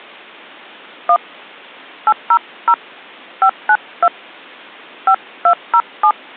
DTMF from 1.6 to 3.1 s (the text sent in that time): 800